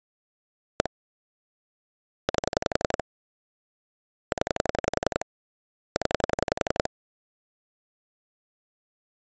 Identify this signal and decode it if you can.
Pulse dialling, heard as clicks on a phone line, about 11 pulses a second. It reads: 1 8 0 0